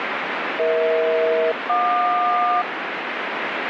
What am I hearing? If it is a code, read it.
Aircraft SELCAL, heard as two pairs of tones, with radio static. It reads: EH-JQ